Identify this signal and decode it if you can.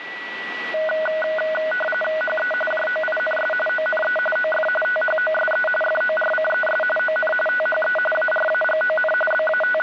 RTTY (45.45 baud, 850 Hz shift), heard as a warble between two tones, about 1050 Hz centre, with radio static and a steady whistle near 1950 Hz. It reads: HE JOINS ONE OF THOSE FORCES ON THE ARAGON …